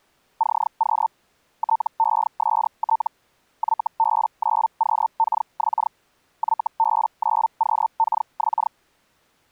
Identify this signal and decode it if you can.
Hellschreiber (Feld-Hell, 122.5 baud), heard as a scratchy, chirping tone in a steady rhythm, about 900 Hz. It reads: CQ TEST YB9QKX YB9QKX